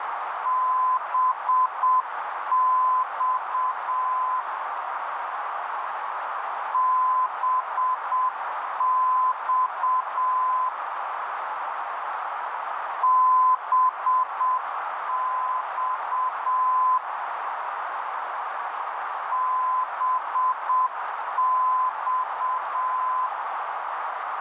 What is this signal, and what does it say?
Morse code, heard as a keyed tone, machine-sent, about 7 wpm, 1020 Hz, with heavy radio static and a narrow filter. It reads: BX BX BX BX